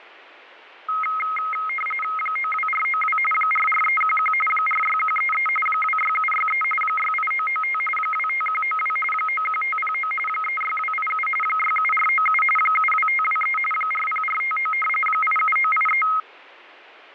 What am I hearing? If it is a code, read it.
RTTY (45.45 baud, 850 Hz shift), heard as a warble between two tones, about 1700 Hz centre. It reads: 92492 44311 46133 26763 68995 25192 91509 36287 67497 72523 40459 87983